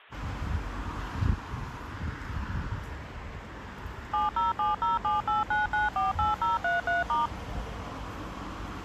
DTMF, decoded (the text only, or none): 7070789948033*